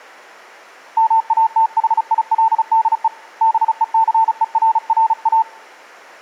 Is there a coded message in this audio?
Yes: Morse code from 0.9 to 5.5 s, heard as a keyed tone, hand-sent with a paddle, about 35 wpm, 900 Hz. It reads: MATHILDE BECERRA